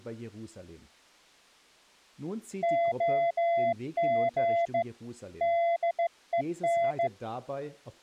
Morse code, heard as a keyed tone, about 15 wpm, 680 Hz, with speech in German. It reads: OG DEN